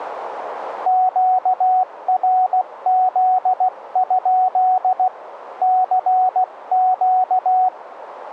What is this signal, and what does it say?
Morse code, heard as a keyed tone, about 16 wpm, 740 Hz, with radio static. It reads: QRZ? CQ